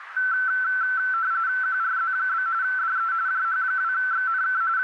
RTTY (45.45 baud, 170 Hz shift), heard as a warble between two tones, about 1430 Hz centre, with radio static and a narrow filter. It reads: QRZ? DE JH2XNK …